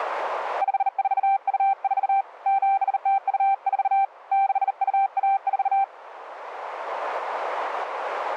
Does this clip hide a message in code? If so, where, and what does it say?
Yes: Morse code (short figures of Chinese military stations) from 0.6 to 5.9 s, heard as a keyed tone, hand-sent with a bug key, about 39 wpm, 780 Hz. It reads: 5424 7024 6214